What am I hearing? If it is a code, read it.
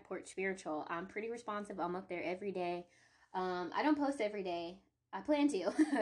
Speech in English. There is no code.